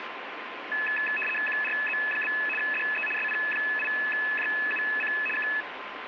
RTTY (75 baud, 850 Hz shift), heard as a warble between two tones, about 2150 Hz centre, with radio static. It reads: QRZ? DE SP8JUC K